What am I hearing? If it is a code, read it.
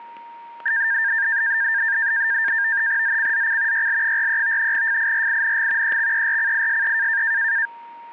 NAVTEX (SITOR-B), 100 baud, 170 Hz shift, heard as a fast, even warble, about 1700 Hz centre, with static crashes and a steady whistle near 930 Hz. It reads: ZCZC YL43 FIRING EXERCISE